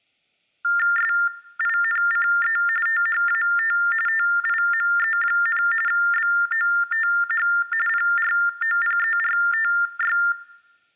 TTY/TDD text telephone tones (45.45 baud Baudot), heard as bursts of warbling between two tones, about 400 Hz shift, 1600 Hz centre. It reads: SINCE THAT TIME, BOTH PROPERTY